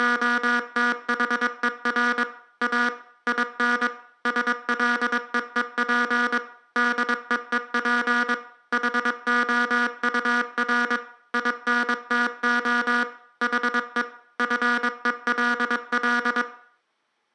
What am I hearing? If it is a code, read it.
Morse code, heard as a buzzer, machine-sent, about 22 wpm, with room echo. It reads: … A IN SLEEP DEEP HOUR INTO HE FELL